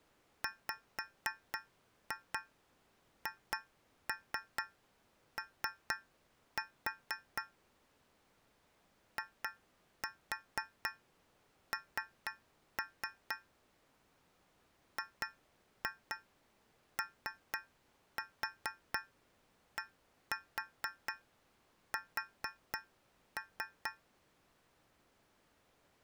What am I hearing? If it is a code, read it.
Tap code, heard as taps on a metal pipe, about 4 knocks a second. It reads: WHO IN GODS